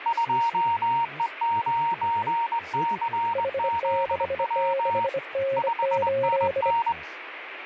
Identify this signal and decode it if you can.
Morse code, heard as two keyed tones, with radio static and speech in Kashmiri. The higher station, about 22 wpm, 930 Hz: 2E9CZW 5NN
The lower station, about 25 wpm, 540 Hz: H66N8